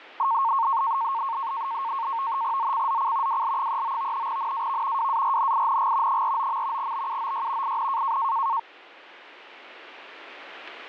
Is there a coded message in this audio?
Yes: NAVTEX (SITOR-B), 100 baud, 170 Hz shift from 0.2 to 8.6 s, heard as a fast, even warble, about 1000 Hz centre. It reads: ZCZC WL39 NAV WARNING 49. BUOY IN